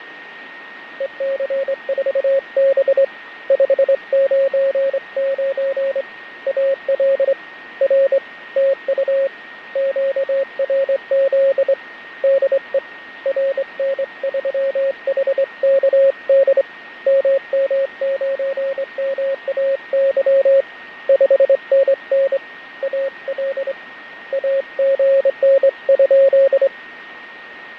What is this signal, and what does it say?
Morse code, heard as a keyed tone, hand-sent with a straight key, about 24 wpm, 540 Hz, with radio static, fading and a steady whistle near 1860 Hz. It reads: EC4B 599 AL R TU QRZ DE RN3HKD MM9MAY 5NN AL AGN?